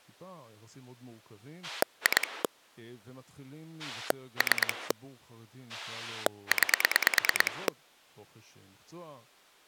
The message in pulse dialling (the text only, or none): 2 3 9